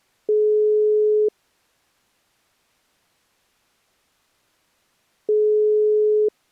Telephone call progress tone (single-tone plan, as in most of Europe), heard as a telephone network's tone, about 420 Hz, 1 s on and 4 s off. Ringback tone.